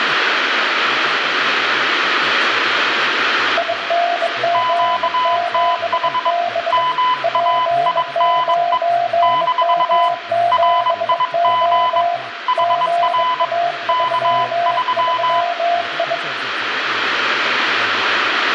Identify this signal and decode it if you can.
Morse code, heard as two keyed tones, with radio static, room echo and speech in Thai. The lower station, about 22 wpm, 690 Hz: ING7B P9M7O GA33I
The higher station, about 22 wpm, 1000 Hz: QTH MAINE - RIG HR K3